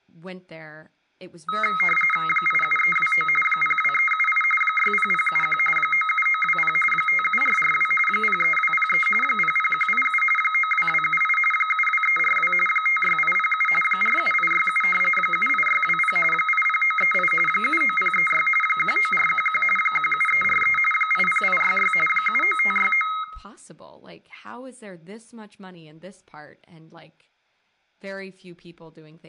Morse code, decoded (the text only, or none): none